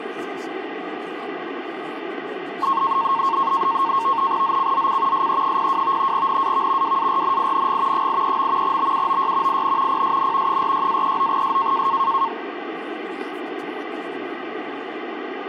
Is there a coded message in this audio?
Yes: NAVTEX (SITOR-B), 100 baud, 170 Hz shift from 2.6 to 12.3 s, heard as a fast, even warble, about 1000 Hz centre, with radio static and speech in English. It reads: ZCZC SE02 NAV WARNING 83. BUOY IN PSN 46-39S